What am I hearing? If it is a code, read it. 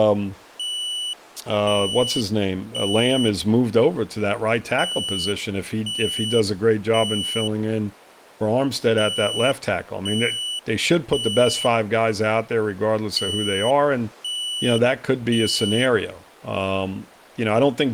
Alarm pattern, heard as an alarm's beeps, played four times, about 2950 Hz, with speech in English. Temporal three. Smoke or fire, evacuate.